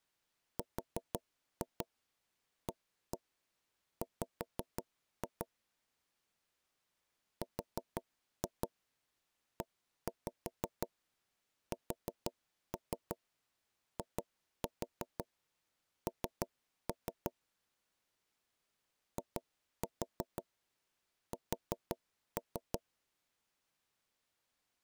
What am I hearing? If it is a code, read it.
Tap code, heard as knocks on wood, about 5 knocks a second. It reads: RAW RESIN IS